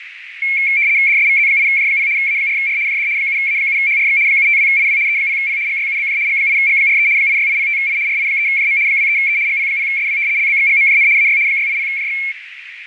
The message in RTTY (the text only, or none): DSVZ8J0 A4R JD 7A7HRX 752IW E0P GYUBJ G8G43 86805I RI3JM 23E GP0SW LBXGMJN AY 680JX